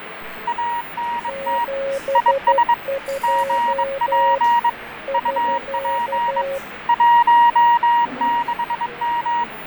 Morse code, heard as two keyed tones, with radio static, fading and the noise of a cafe. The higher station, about 22 wpm, 950 Hz: ANT IS GP UP 16M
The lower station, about 12 wpm, 550 Hz: 72 <SK>